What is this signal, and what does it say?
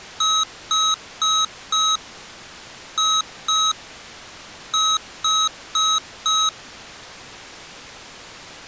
Beep code, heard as beeps from a small speaker, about 1280 Hz. 4-2-4. In Phoenix BIOS tables: unexpected interrupt in protected mode.